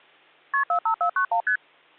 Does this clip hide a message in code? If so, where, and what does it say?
Yes: multi-frequency trunk signalling (R1, as on North American trunks) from 0.5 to 1.6 s, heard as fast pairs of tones, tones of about 90 ms. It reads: KP 45491 ST